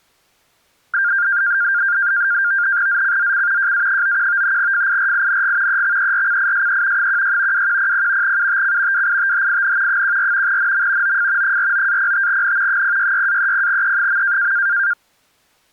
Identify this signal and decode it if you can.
NAVTEX (SITOR-B), 100 baud, 170 Hz shift, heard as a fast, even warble, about 1500 Hz centre. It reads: ZCZC JA91 FIRING EXERCISE 16 2100 UTC WITHIN 14 NM OF 49-05N 066-30E.